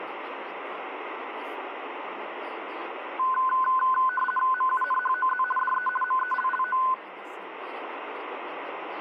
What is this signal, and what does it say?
RTTY (50 baud, 450 Hz shift), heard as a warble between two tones, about 1260 Hz centre, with radio static and speech in Manipuri. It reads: MUNHOZ DE MELLO